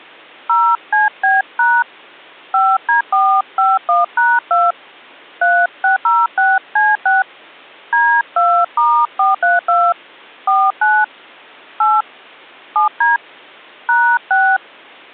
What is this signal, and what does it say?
DTMF, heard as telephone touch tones, dialled by hand, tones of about 200 ms. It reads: 0CB# 5D451#2 3606C6 D2*432 49 8 7D #6